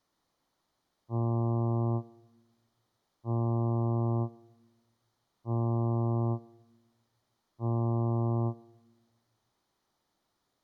Ship horn signal, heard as a ship's horn, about 120 Hz. 4 short. At sea: a pilot vessel's identity signal in fog.